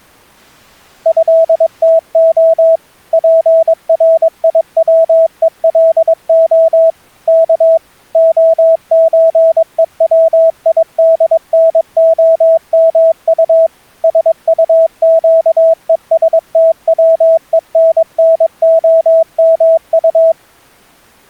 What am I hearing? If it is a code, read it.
Morse code (Russian alphabet), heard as a keyed tone, machine-sent, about 22 wpm, 650 Hz. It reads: ЭТО ПРИВЕЛО К ОЧЕВИДНОМУ СУЩЕСТВЕННОМУ